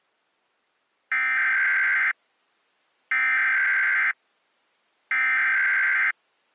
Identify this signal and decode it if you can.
Emergency Alert System (SAME) tones (header bursts), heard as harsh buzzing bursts, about 520.83 baud.